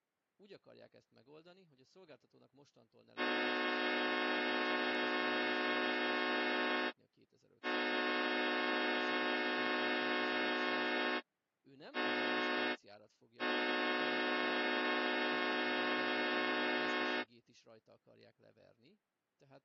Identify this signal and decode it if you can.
Train horn signal, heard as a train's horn, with speech in Hungarian. 2 long, 1 short, 1 long. On North American railways: approaching a public crossing.